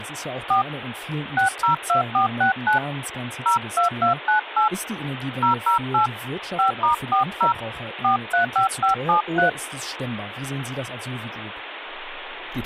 DTMF, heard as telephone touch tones, dialled by hand, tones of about 120 ms, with phone line noise and speech in German. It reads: 4 602469 02298 008 5*40 435573